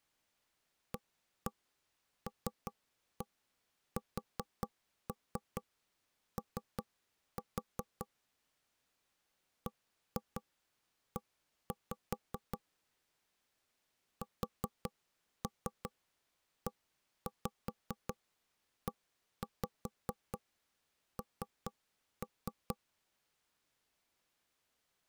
Tap code, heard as knocks on wood, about 4 knocks a second. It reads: ALSO BE SEEN